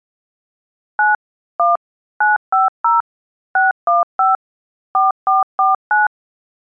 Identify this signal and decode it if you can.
DTMF, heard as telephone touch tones, dialled by machine, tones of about 160 ms. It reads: 9 1 950 615 4449